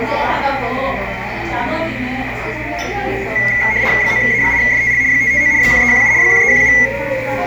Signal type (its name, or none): RTTY